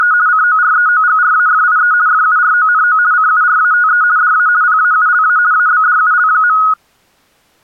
RTTY (50 baud, 170 Hz shift), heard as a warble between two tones, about 1360 Hz centre. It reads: … COREOGRAFIE FURONO CURATE DA PAULA ABDUL.